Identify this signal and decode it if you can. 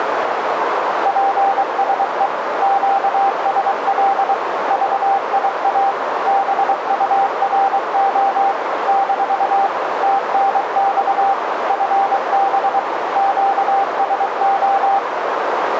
Morse code, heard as a keyed tone, machine-sent, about 23 wpm, 790 Hz, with radio static and a narrow filter. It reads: PSE QSL VIA BURO - TNX FB QSO